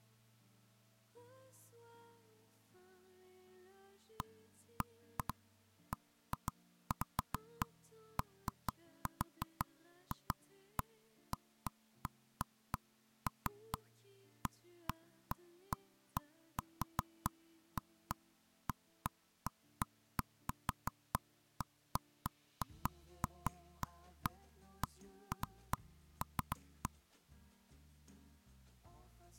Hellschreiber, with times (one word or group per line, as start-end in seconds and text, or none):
none